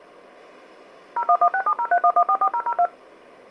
DTMF, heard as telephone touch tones, dialled by machine, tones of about 70 ms. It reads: 01167031144002